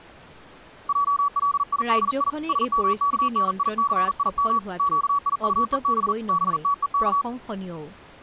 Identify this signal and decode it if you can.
Morse code (Hebrew alphabet), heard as a keyed tone, hand-sent with a paddle, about 40 wpm, 1140 Hz, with speech in Assamese. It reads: עלידי שמכניסים קיטוב בתוך